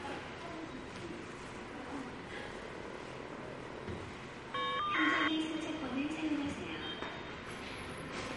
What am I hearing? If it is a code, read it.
Caller ID data burst, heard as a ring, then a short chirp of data, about 1200 baud, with the noise of a subway station.